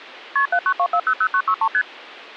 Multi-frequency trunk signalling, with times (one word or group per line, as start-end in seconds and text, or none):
0.4-0.5 KP
0.5-1.7 792400963
1.7-1.8 ST